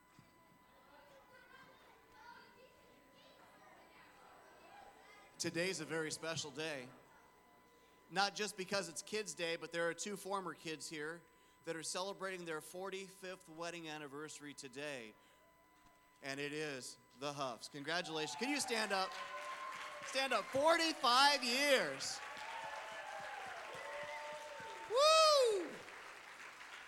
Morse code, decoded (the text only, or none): none